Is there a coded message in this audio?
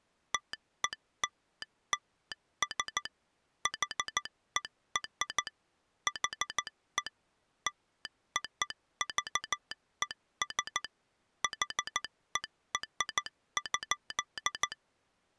Yes: Morse code (American railroad code) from 0.3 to 14.8 s, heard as a telegraph sounder, machine-sent. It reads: TELLS HER HE LOVES HER.